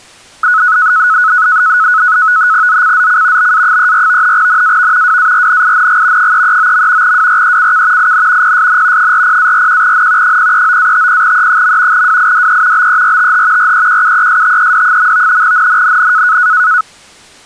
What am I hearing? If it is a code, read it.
NAVTEX (SITOR-B), 100 baud, 170 Hz shift, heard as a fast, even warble, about 1380 Hz centre. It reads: ZCZC BA34 NAV WARNING 339. WRECK IN PSN 40-41N 039-50E. WIDE BERTH REQUESTED. NNNN